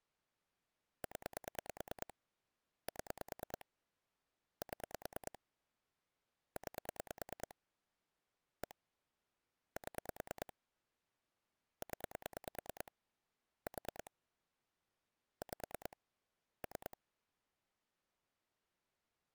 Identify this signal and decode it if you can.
Pulse dialling, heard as clicks on a phone line, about 9 pulses a second. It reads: 0 7 7 9 1 7 0 4 5 3